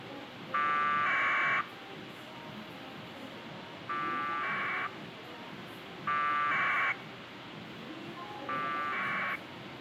Packet radio (AX.25, as in APRS), 1200 baud, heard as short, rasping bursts, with radio hiss and the noise of a crowd indoors.